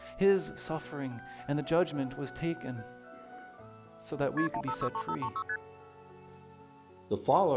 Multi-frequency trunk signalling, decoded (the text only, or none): KP 1563536 ST